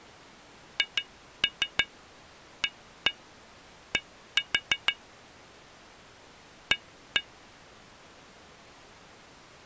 Tap code, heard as taps on glass, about 6 knocks a second. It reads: HAD A